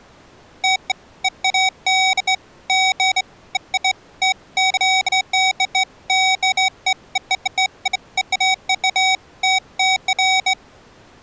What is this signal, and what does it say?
Beeps of irregular length. There is no code.